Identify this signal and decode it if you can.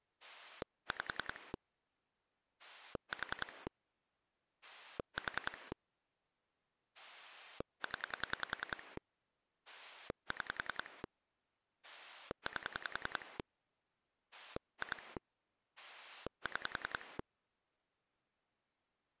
Pulse dialling, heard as a rotary dial, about 10 pulses a second. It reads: 5 4 4 0 6 8 2 6